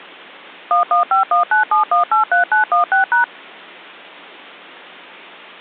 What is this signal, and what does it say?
DTMF, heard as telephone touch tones, dialled by machine, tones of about 120 ms. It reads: 115197183916#